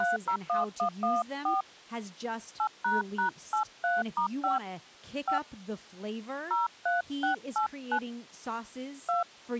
DTMF, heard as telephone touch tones, dialled by hand, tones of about 130 ms, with speech in English. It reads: 301114 8##83*5 5 03689 2